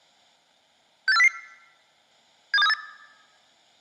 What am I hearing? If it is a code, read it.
Five-tone selective call (EEA), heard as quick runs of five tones, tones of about 40 ms. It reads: 68400 72738